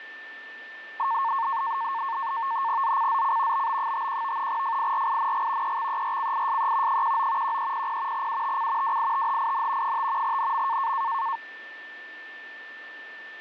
NAVTEX (SITOR-B), 100 baud, 170 Hz shift, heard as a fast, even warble, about 1000 Hz centre, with a steady whistle near 1780 Hz. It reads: ZCZC BB51 FIRING EXERCISE 19 1300 UTC WITHIN 5 NM